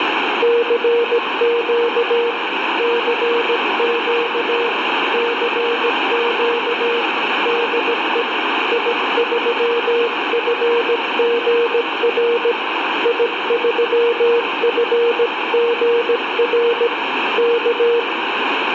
Morse code, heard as a keyed tone, hand-sent with a paddle, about 17 wpm, 470 Hz, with heavy radio static. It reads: CQ CQ CQ DE I3FGR I3FGR K